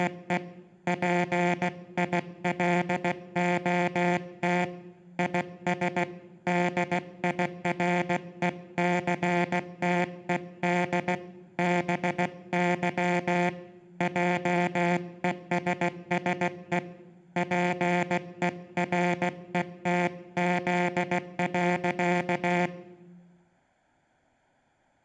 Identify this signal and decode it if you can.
Morse code, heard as a buzzer, hand-sent with a paddle, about 16 wpm. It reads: … PILOT IS DIRECTED BY JESSE PERETZ.